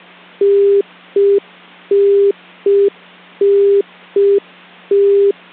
Telephone call progress tone (UK plan), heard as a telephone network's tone, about 400 Hz. Congestion tone.